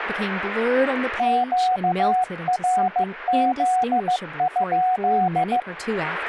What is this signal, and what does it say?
Morse code, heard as a keyed tone, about 15 wpm, 740 Hz, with speech in English. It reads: QRZ?